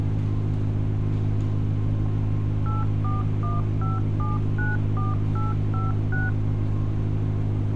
DTMF, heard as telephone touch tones, dialled by machine, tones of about 170 ms, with street noise. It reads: 8415794856